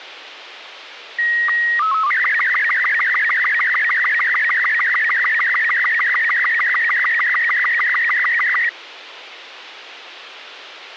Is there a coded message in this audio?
Yes: SSTV (slow-scan television), Robot 36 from 1.2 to 8.7 s, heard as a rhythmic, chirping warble, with radio hiss.